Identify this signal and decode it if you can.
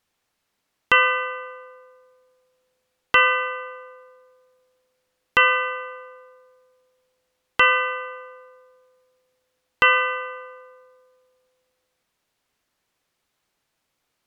Clock strike, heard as a bell. 5. Five o'clock.